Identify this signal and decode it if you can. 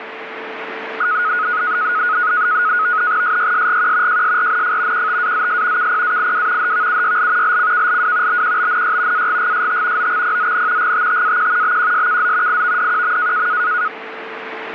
NAVTEX (SITOR-B), 100 baud, 170 Hz shift, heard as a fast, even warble, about 1360 Hz centre, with radio static and a steady whistle near 440 Hz. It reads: SYSGQ JSRNF QTAZS KPAIW HVUYL LCKLW BQBNY AGGST OXPZN GTTAQ BQSKZ IVDQM